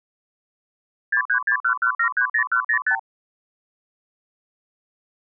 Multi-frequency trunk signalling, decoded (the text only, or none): 63611730105